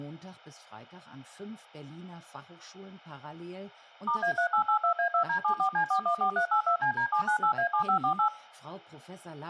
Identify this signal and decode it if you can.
DTMF, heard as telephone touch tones, dialled by machine, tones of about 100 ms, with speech in German. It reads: *A3882A2D74C414382CD798A7548